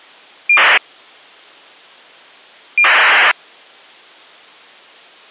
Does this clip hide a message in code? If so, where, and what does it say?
Yes: ACARS aircraft data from 0.5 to 3.3 s, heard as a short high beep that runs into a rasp, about 2400 baud.